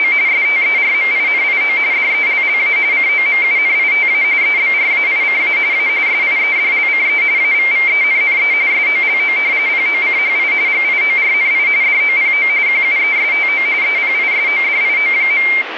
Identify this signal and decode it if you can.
RTTY (45.45 baud, 170 Hz shift), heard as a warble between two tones, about 2200 Hz centre, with radio static. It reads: … STERMINIO DELLA COMUNITA EBRAICA A SIEDLCE AVVENNE SOLO POCHI GIORNI DOPO QUESTO EPISODIO.